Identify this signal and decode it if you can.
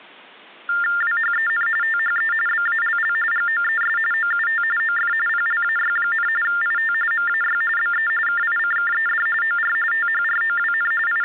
TTY/TDD text telephone tones (45.45 baud Baudot), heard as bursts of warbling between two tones, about 400 Hz shift, 1600 Hz centre. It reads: WHEN THE BALL GOES OUT OF PLAY, IT MAY BE KICKED OR THROWN …